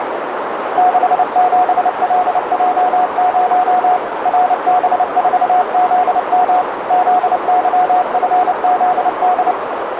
Morse code, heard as a keyed tone, machine-sent, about 29 wpm, 730 Hz, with heavy radio static and a narrow filter. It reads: 67LJ0 RB4ZM ZYFZD